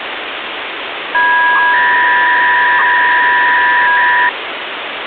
300-baud modem data (V.21 tones), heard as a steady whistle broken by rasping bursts, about 300 baud, 200 Hz shift, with phone line noise.